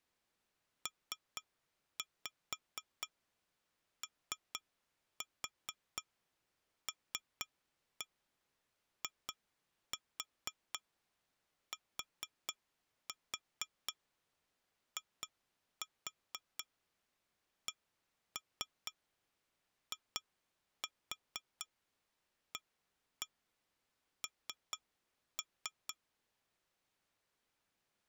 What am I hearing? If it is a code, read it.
Tap code, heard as taps on glass, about 4 knocks a second. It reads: POLITICIAN